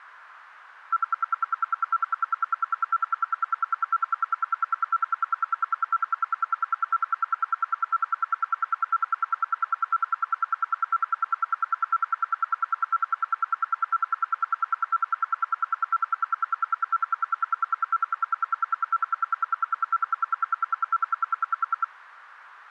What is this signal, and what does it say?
Radio time signal (RWM, Moscow), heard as ten pulses a second.